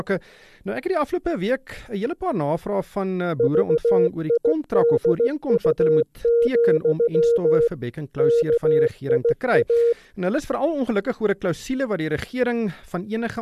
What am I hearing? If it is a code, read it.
Morse code, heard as a keyed tone, machine-sent, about 16 wpm, 470 Hz. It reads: VIDU, KIA